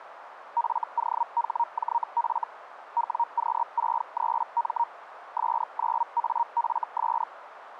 Hellschreiber (Feld-Hell, 122.5 baud), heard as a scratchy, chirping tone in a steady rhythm, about 940 Hz, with radio static. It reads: FOHJF WQ63M S9AFS